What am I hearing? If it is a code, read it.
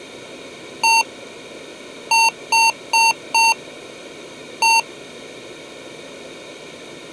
Beep code, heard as beeps from a small speaker, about 910 Hz. 1-4-1. In Phoenix BIOS tables: address line failure in the first 64 KB of memory.